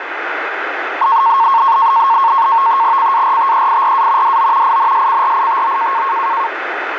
NAVTEX (SITOR-B), 100 baud, 170 Hz shift, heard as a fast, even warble, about 1000 Hz centre, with radio static. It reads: CARTEIRA DO INSCRITO